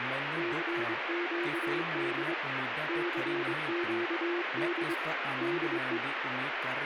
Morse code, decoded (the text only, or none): CQD CQD DE